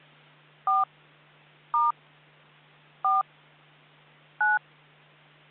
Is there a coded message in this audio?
Yes: DTMF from 0.7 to 4.6 s, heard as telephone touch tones, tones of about 170 ms, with hum. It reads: 4 * 4 9